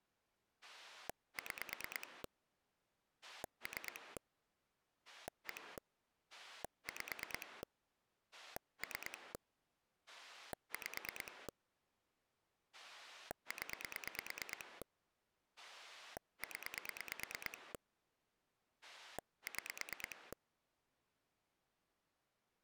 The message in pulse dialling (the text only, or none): 6 3 1 5 3 5 0 0 6